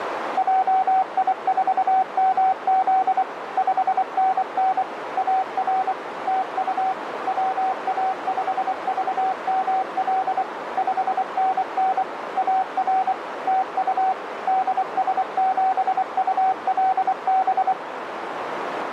Morse code, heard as a keyed tone, machine-sent, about 24 wpm, 760 Hz, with radio static and a narrow filter. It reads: JI4MZ 5NN AR TU WA5VML 5NN AR TU DS7ULB